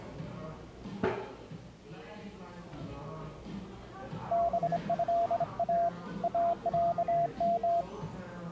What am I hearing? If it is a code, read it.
Morse code (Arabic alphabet), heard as a keyed tone, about 26 wpm, 680 Hz, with the noise of a cafe. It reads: بها اعم